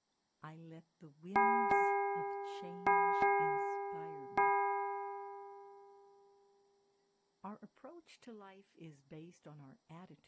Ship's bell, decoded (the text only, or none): 5